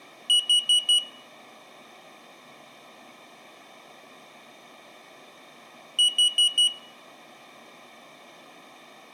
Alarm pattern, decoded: temporal four

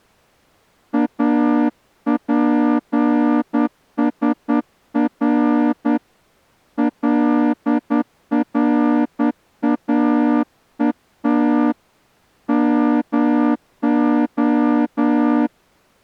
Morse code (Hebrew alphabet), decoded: אפשר לראות מה

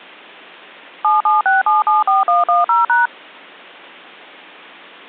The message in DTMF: 776774110#

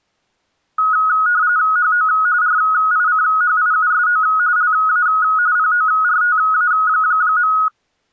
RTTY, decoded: HO RICHIUSO LA PORTA.

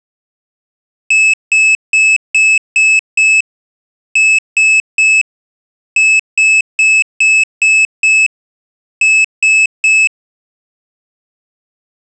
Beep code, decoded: 6-3-6-3

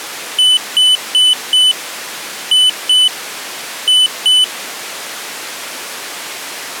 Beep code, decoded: 4-2-2

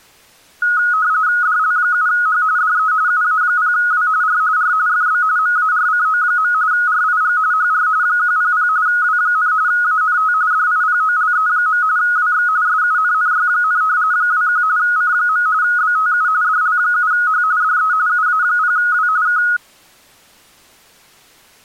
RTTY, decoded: DL7H DE UA0W R R FB MARCO. RIG HR 100 W, ANT DIPOLE. WX SUNNY, 21 C. BTU DL7H DE UA0W K

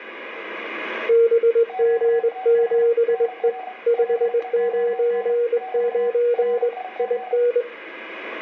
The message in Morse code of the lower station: BG7E 599 IN

